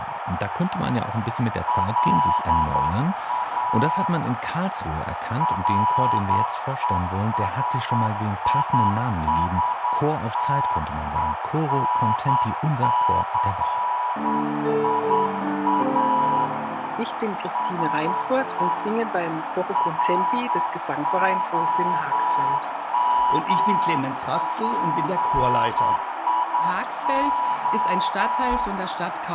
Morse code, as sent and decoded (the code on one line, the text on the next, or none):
.-.. .- / .-. . ... .. ... - . -. -.-. .. .- / ... . / .-. --- -- .--. .. ---
LA RESISTENCIA SE ROMPIO